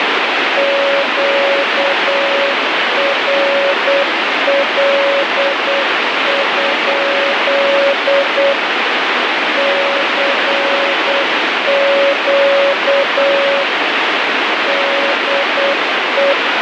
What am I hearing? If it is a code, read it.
Morse code, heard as a keyed tone, machine-sent, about 8 wpm, 560 Hz, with heavy radio static. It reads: QRL? CQ DE